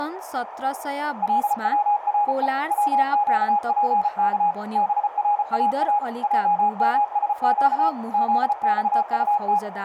Morse code, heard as a keyed tone, machine-sent, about 34 wpm, 830 Hz, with radio static, a narrow filter and speech in Nepali. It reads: LWRE WQPK BRAA JMSQ ZXUT